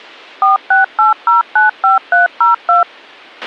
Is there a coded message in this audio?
Yes: DTMF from 0.4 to 2.8 s, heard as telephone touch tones, dialled by machine, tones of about 140 ms, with a squelch burst at the end. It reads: 468095302